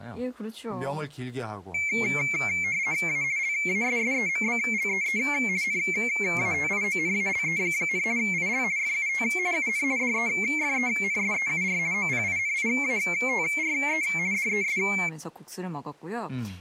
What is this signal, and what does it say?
RTTY (50 baud, 170 Hz shift), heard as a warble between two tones, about 2250 Hz centre, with speech in Korean. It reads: A LASSEMBLEE NATIONALE, IL FUT UN DEFENSEUR OPINIATRE DES